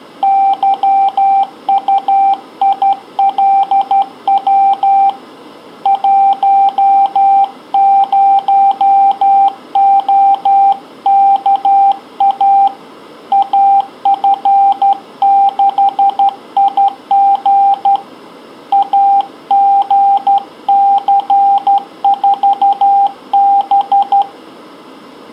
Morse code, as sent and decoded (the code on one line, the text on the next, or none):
-.-- ..- .. .-.. .-- / .---- ----- --- -.- .- / .- ..-. -.... .. --. / .- --. -.-. ....- -...
YUILW 10OKA AF6IG AGC4B